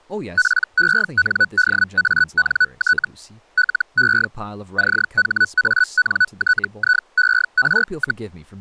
Hellschreiber (Feld-Hell, 122.5 baud), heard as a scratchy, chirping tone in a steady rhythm, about 1490 Hz, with speech in English. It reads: PENDANT LE CHANTIER,